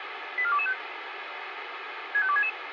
Five-tone selective call (ZVEI), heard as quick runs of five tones, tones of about 70 ms, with radio hiss. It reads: 84225 65266